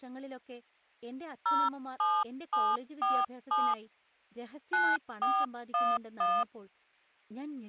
DTMF, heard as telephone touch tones, dialled by hand, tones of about 230 ms, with speech in Malayalam. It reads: 07747 9411